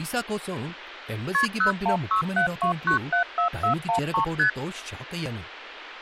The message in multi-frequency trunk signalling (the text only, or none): KP 01672974413 ST